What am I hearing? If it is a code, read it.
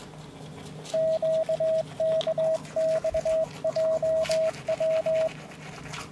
Morse code, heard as a keyed tone, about 22 wpm, 640 Hz, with the noise of a restroom. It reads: QKXJW